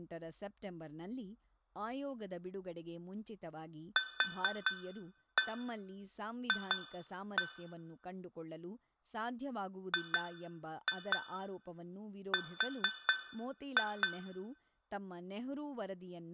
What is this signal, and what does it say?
Tap code, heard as taps on glass, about 4 knocks a second, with room echo and speech in Kannada. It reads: QF GR